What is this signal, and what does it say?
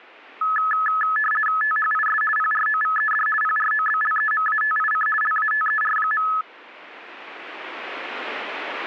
RTTY (50 baud, 450 Hz shift), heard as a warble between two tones, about 1500 Hz centre, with radio static. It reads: THIS PROVED PROBLEMATIC LATER.